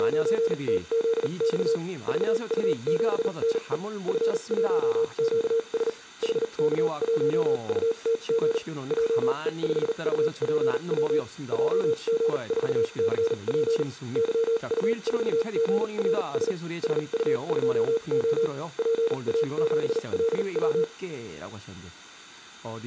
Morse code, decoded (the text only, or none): … VU7NE F1QS HK1UTG JE5UPW JG4CP YU4GRS SU2O PA7LW